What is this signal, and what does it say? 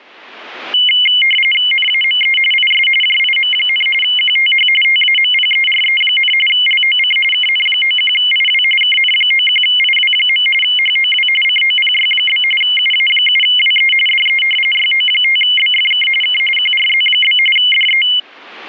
RTTY (45.45 baud, 850 Hz shift), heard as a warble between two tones, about 2550 Hz centre. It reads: NAME IS JIM, QTH TAMPERE, LOC KN91IW KN91IW. HOW COPY? UA7WE DE YO5BFK K QRZ? DE